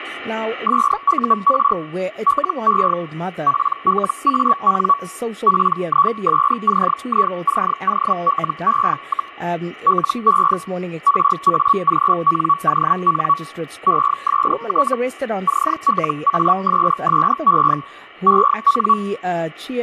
Hellschreiber (Feld-Hell, 122.5 baud), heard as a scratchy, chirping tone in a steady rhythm, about 1130 Hz, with a steady whistle near 2290 Hz and speech in English. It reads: SUR LE PLAN PISCICOLE, LE RAGNON EST CLASSE EN